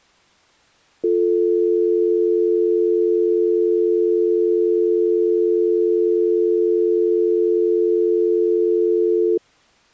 Telephone call progress tone (North American or UK plan), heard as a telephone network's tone, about 350, 440 Hz. Dial tone.